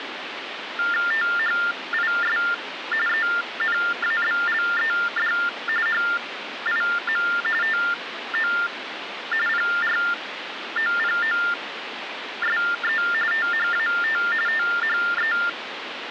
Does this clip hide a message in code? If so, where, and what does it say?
Yes: TTY/TDD text telephone tones (45.45 baud Baudot) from 0.8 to 15.5 s, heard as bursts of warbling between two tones, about 400 Hz shift, 1600 Hz centre, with phone line noise. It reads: THIS ENABLED HIM TO PROPOSE THAT THE